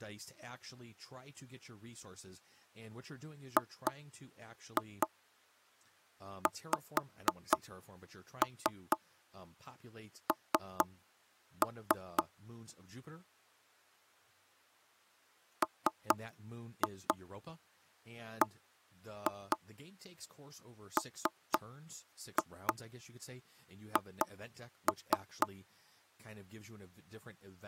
Tap code, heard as knocks on wood, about 4 knocks a second, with speech in English. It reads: GXN MBMH